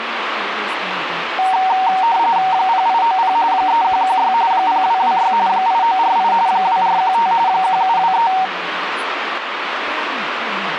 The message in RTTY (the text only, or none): 0890 3116 0226 8948 2415 1723